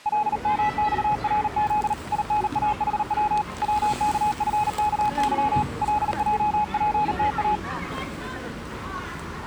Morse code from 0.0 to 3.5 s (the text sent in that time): LMXRZ INAHW